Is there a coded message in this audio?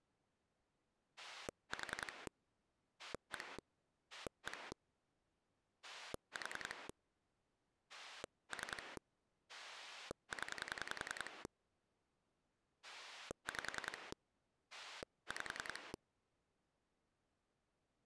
Yes: pulse dialling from 1.2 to 16.0 s, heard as a rotary dial, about 10 pulses a second. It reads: 4 1 1 4 3 0 5 5